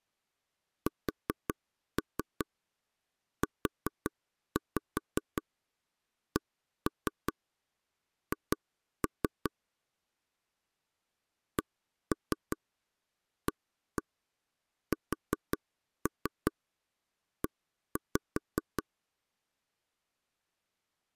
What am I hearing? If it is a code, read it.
Tap code, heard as taps on a table, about 5 knocks a second. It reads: SUCH CASE